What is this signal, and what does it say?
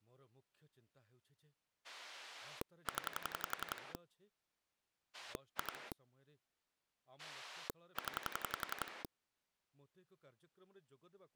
Pulse dialling, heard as a rotary dial, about 11 pulses a second, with speech in Odia. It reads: 0 2 0